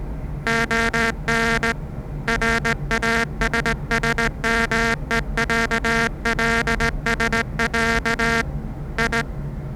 Morse code (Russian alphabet), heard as a buzzer, hand-sent with a straight key, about 18 wpm, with the noise inside a lift. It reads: ОН РАССМЕЯЛСЯ И